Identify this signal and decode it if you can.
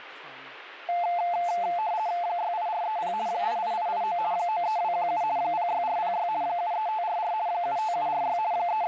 RTTY (50 baud, 170 Hz shift), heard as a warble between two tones, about 780 Hz centre, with radio static and speech in English. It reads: 68430 88889 93217 06406 73544 75746 …